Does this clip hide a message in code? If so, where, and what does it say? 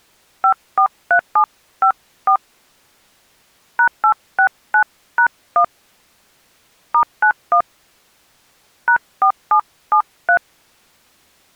Yes: DTMF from 0.4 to 10.4 s, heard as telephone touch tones, dialled by hand, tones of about 90 ms. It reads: 543754 #869#1 *91 #4773